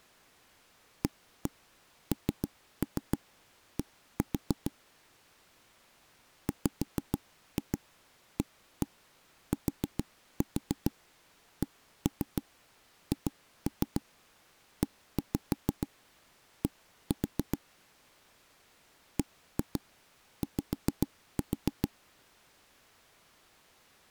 Tap code, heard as knocks on wood, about 6 knocks a second. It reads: AND WATCHED BY